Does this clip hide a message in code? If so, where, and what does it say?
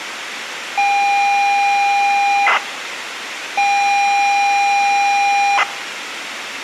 Yes: ZX Spectrum tape loading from 0.8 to 5.6 s, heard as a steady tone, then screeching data, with tape hiss.